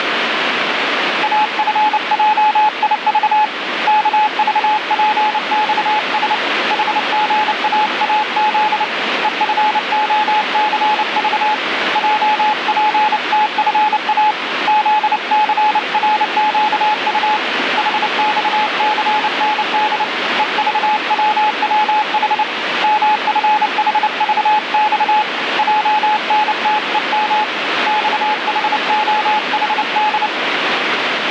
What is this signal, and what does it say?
Morse code, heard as a keyed tone, hand-sent with a paddle, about 29 wpm, 850 Hz, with radio static. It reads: AFJIV KVPXS HGAAZ EFOCV JPTFA ZCRQU HXCND EVWWH MFHVX JNTEM XHOHD